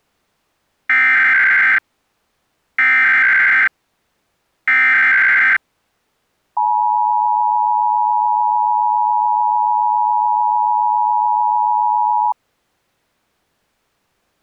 Emergency Alert System (SAME) tones (header bursts, then the 853 and 960 Hz attention tone), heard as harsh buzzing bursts, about 520.83 baud.